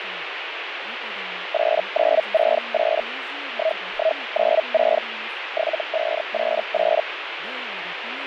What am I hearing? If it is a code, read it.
Hellschreiber (Feld-Hell, 122.5 baud), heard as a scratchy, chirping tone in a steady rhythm, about 640 Hz, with radio static. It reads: 8968 1196 7588